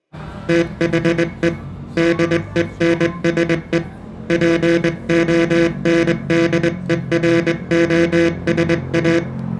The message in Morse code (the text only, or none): THE DENSE PONDEROSA